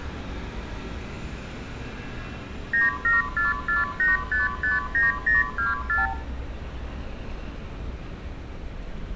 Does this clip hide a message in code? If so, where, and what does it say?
Yes: multi-frequency trunk signalling (R2, with the far end's replies) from 2.7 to 6.1 s, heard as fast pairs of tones, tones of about 160 ms, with room echo and street noise. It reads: 97448559024